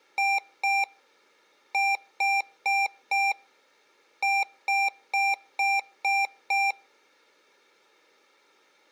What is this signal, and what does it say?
Beep code, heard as beeps from a small speaker, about 790 Hz. 2-4-6.